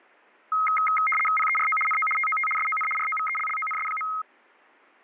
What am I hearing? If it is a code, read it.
RTTY (75 baud, 850 Hz shift), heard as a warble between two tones, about 1700 Hz centre. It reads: PERO NO TOT SON ROVELLONS.